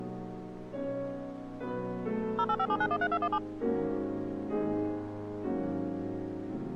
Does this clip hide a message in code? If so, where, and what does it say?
Yes: DTMF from 2.4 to 3.4 s, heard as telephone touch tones, dialled by machine, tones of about 60 ms. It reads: 0857913217